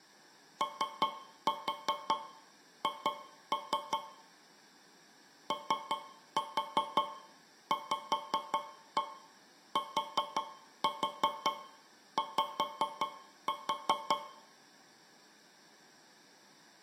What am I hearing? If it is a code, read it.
Tap code, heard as taps on a metal pipe, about 5 knocks a second, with room echo. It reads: OH OVTY